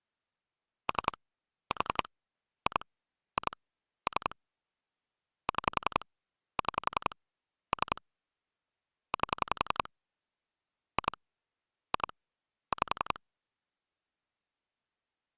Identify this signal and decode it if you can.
Pulse dialling, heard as clicks on a phone line, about 11 pulses a second. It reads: 3 4 2 2 3 6 6 3 8 2 2 5